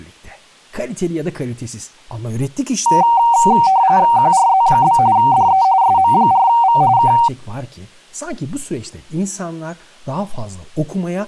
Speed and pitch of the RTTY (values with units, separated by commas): 45.45 baud, 170 Hz shift, 850 Hz centre